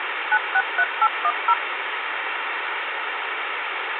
DTMF, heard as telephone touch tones, dialled by machine, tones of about 60 ms, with phone line noise. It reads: 963810